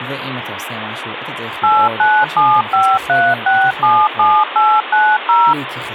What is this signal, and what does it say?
DTMF, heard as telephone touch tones, dialled by machine, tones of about 240 ms, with phone line noise and speech in Hebrew. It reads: 89753677890